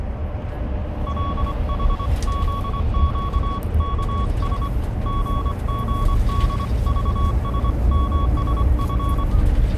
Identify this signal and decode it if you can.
Morse code (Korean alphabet), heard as a keyed tone, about 24 wpm, 1120 Hz, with the noise inside a car. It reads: 구태여 쓰려면